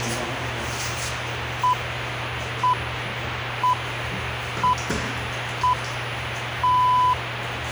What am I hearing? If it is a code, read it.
Radio time signal (six pips, as the Greenwich Time Signal), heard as pips, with radio hiss and the noise inside a lift.